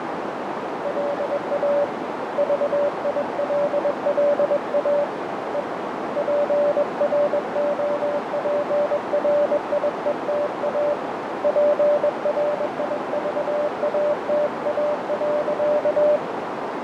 Morse code, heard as a keyed tone, hand-sent with a bug key, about 21 wpm, 580 Hz, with heavy radio static, fading and a narrow filter. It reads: LA VILLA E PROPRIETA PRIVATA.